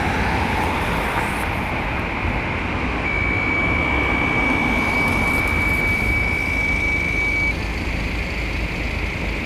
PSK63 (62.5 baud), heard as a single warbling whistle, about 2300 Hz, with radio static, a narrow filter and street noise.